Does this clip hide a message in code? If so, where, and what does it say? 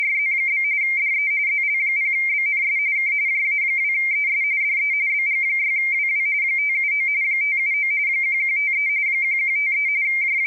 Yes: RTTY (45.45 baud, 170 Hz shift) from 0.0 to 10.5 s, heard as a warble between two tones, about 2200 Hz centre. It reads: … DE ZL0BNS K JA2ES DE BG6WW 579 579 1153 1153 …